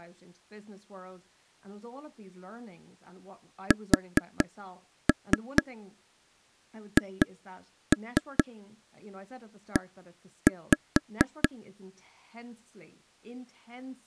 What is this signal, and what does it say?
Tap code, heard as taps on a table, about 4 knocks a second, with speech in English. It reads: SHE